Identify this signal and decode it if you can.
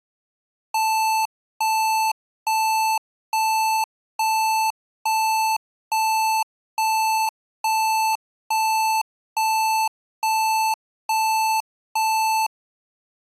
Evenly repeated beeps. There is no code.